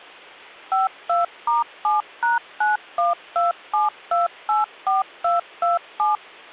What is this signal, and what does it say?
DTMF, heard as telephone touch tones, dialled by machine, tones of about 160 ms. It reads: 52*7#9127284227